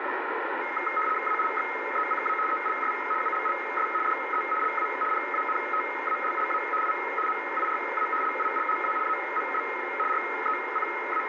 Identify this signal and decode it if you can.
RTTY (75 baud, 850 Hz shift), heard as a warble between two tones, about 1700 Hz centre, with radio static. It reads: AIXECA ELS ULLS DE LA PANTALLA I MIRA LILLA AMB …